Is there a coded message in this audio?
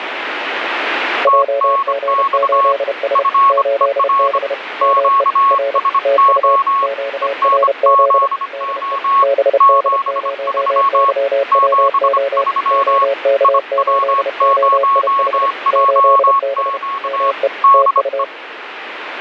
Yes: Morse code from 1.2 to 18.3 s, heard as two keyed tones, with radio static. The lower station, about 31 wpm, 550 Hz: JG8S 8B ME R TU QRZ DE BD0YWO OK8OIH 8B ME TU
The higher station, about 25 wpm, 1100 Hz: TNX FER QSO ENZO 73 73 IW0JQ DE